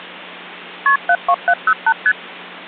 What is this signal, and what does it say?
Multi-frequency trunk signalling (R1, as on North American trunks), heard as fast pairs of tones, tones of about 60 ms. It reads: KP 72708 ST